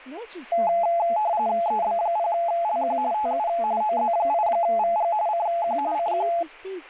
RTTY (45.45 baud, 170 Hz shift), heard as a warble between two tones, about 770 Hz centre, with speech in English. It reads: EB0LQ TU OZ8VG CQ CQ